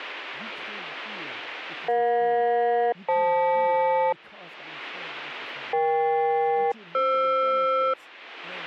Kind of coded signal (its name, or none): aircraft SELCAL